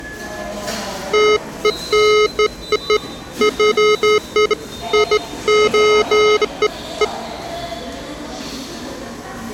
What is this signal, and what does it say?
Beeps of irregular length, with the noise of a subway station. There is no code.